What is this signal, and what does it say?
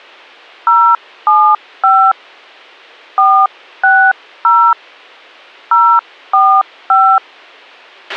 DTMF, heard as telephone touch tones, dialled by hand, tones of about 280 ms, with a squelch burst at the end. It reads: 075 460 045